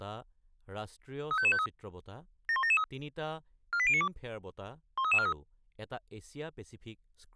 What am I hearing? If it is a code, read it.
Five-tone selective call (ZVEI), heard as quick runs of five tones, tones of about 70 ms, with speech in Assamese. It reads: 35553 71773 48092 13343